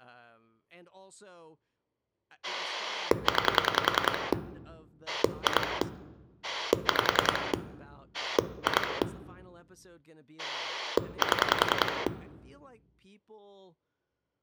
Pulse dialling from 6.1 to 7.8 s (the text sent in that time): 5